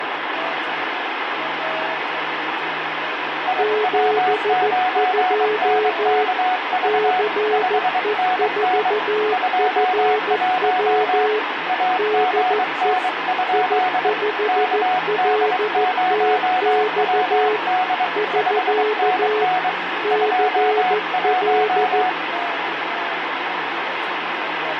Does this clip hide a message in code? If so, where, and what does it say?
Yes: Morse code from 3.4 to 22.2 s, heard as two keyed tones, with radio static. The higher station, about 23 wpm, 740 Hz: IW9NKV 5NN 21 AGN? KD0WD 5NN 21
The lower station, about 14 wpm, 430 Hz: 72 CE4FW DE I5LTX <SK> CL